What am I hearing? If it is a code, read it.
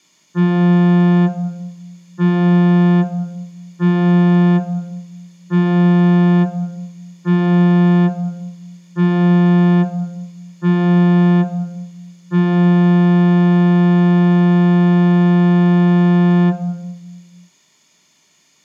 Ship horn signal, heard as a ship's horn, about 180 Hz, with room echo. 7 short, 1 long. At sea: general emergency alarm.